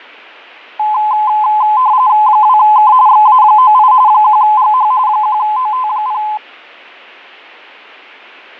RTTY (45.45 baud, 170 Hz shift), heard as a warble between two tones, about 940 Hz centre, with fading. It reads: 2K XA98 1GH 1OT0